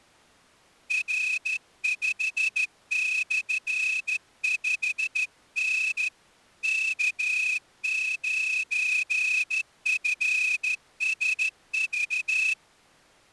Morse code, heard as a whistle, hand-sent with a straight key, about 14 wpm. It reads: R5/5N K9FSV